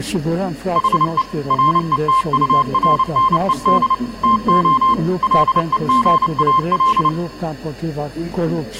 Morse code, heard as a keyed tone, machine-sent, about 29 wpm, 1050 Hz. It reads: HE RETURNED TO LEGAL